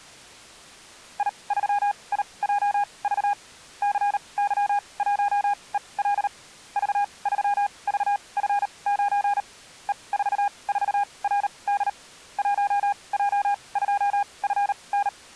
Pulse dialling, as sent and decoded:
none

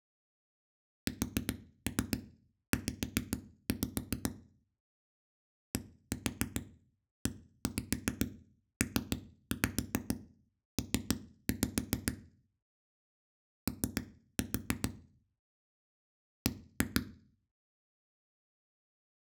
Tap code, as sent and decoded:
4-3 5-5 / 1-4 1-5 3-5 3-5 / 3-4 / 1-2
SZ DEPP O B

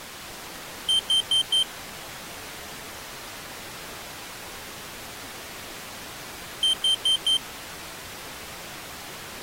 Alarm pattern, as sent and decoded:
4 beeps and a pause
temporal four

